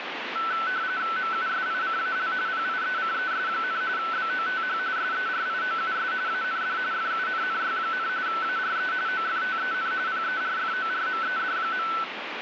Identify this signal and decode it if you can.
RTTY (45.45 baud, 170 Hz shift), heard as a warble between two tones, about 1420 Hz centre, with radio static. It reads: MUSICAL PIECES, BOTH SERIOUS AND FUNNY, ARE OFTEN PERFORMED.